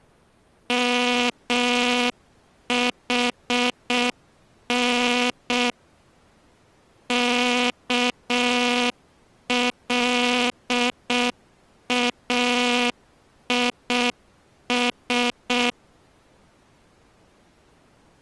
Morse code (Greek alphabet), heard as a buzzer, machine-sent, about 6 wpm. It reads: ΜΗΝ ΚΛΑΙΣ